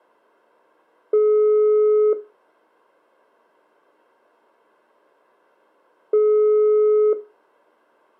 Telephone call progress tone (single-tone plan, as in most of Europe), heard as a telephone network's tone, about 420 Hz, 1 s on and 4 s off. Ringback tone.